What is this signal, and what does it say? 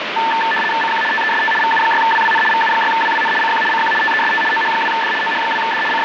RTTY (75 baud, 850 Hz shift), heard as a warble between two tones, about 1330 Hz centre, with radio static. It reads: CQ TEST VU6WWN VU6WWN CQ CQ TEST OH2D OH2D …